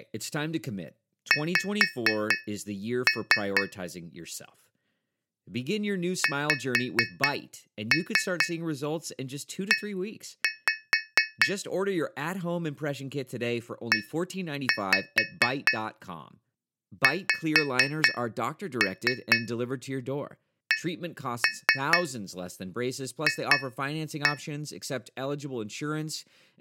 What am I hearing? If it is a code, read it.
Tap code, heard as taps on a metal pipe, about 4 knocks a second, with speech in English. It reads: X XE EXCF